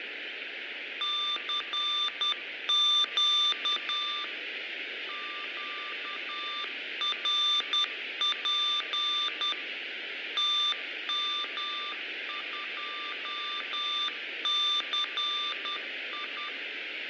Morse code, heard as a keyed tone, machine-sent, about 10 wpm, 1190 Hz, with radio static, fading and room echo. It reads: CQ QRP TM2CI